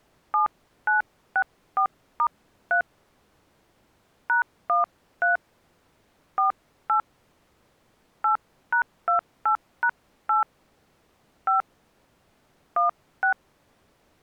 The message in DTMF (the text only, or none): 7964*3 #13 48 8#28#8 5 16